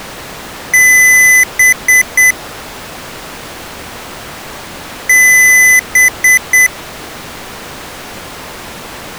Beep code, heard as beeps from a small speaker, played twice, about 2000 Hz. 1 long, 3 short. In Award and IBM BIOS tables: video adapter failure; in AMI BIOS tables: memory failure.